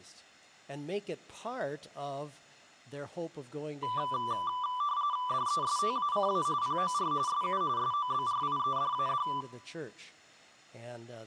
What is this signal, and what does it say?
RTTY (45.45 baud, 170 Hz shift), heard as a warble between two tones, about 1080 Hz centre, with room echo. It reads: DESTACA POR SU SOBRIEDAD